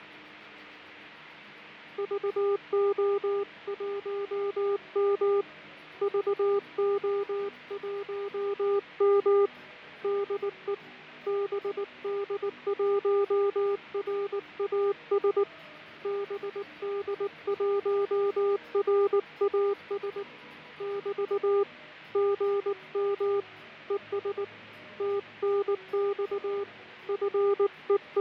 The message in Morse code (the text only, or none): VO1M VO1M DE BD1RAS BD1RAS <BT> GM ES TNX …